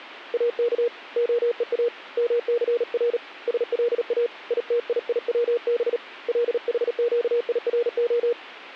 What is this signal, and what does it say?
Morse code (Hebrew alphabet), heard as a keyed tone, hand-sent with a paddle, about 37 wpm, 480 Hz. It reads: אך הוא מסר שלא יתייצב לחקירה